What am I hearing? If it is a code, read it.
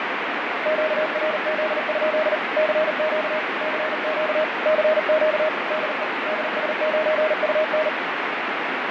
Morse code, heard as a keyed tone, machine-sent, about 39 wpm, 620 Hz, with heavy radio static and fading. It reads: QRZ? CQ CQ CQ DE DS9UN